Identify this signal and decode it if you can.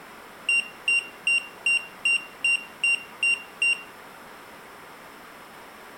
Beep code, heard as a piezo beeper, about 2750 Hz, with room echo. 9 short. In AMI BIOS tables: ROM checksum failure.